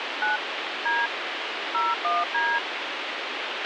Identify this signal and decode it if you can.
DTMF, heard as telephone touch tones, dialled by hand, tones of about 180 ms, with radio hiss and a squelch burst at the end. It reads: 9 D 01D